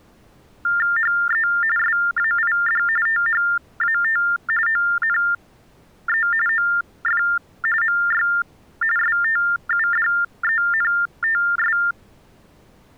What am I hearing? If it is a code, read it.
TTY/TDD text telephone tones (45.45 baud Baudot), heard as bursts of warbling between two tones, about 400 Hz shift, 1600 Hz centre. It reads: HE SAID THAT ONE OF MY STUDENTS